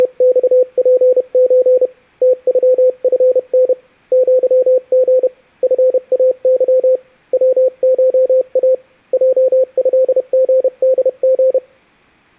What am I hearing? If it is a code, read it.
Morse code (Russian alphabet), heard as a keyed tone, hand-sent with a paddle, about 31 wpm, 510 Hz. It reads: … ТЮФН ЪГ ФАЫ ВША ЙЭГДГ